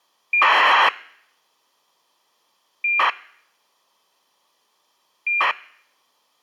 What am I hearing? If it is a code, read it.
ACARS aircraft data, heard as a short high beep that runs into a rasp, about 2400 baud.